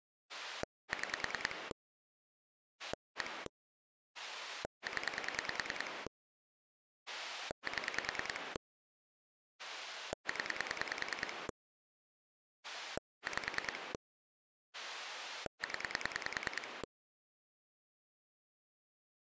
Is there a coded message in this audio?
Yes: pulse dialling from 0.3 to 16.8 s, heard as a rotary dial, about 10 pulses a second. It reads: 6 1 0 7 0 5 0